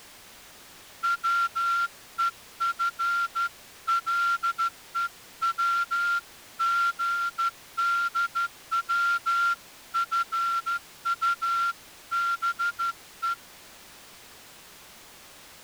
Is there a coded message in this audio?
Yes: Morse code (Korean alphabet) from 1.0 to 13.4 s, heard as a whistle, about 13 wpm. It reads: 반갑습니다